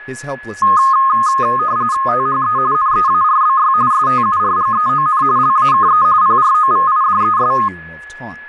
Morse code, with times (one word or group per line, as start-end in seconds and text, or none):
none